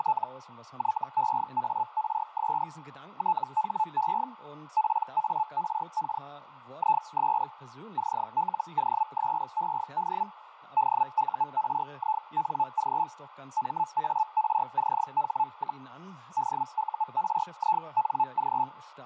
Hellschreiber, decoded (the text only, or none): … YEARS THE PARK IS CLOSED DURING MARCH, DURING